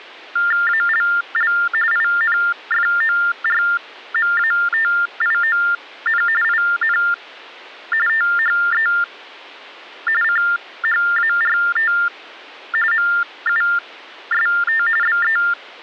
TTY/TDD text telephone tones (45.45 baud Baudot), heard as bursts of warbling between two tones, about 400 Hz shift, 1600 Hz centre. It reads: ALL INFORMATION IN THE CHART MUST BE